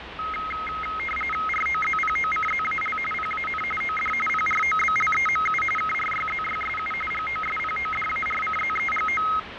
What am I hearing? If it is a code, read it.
RTTY (45.45 baud, 850 Hz shift), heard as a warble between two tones, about 1700 Hz centre, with radio static, fading and street noise. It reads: ROZPOCZAL PAN OD PROBLEMU KRYZYSU GOSPODARCZEGO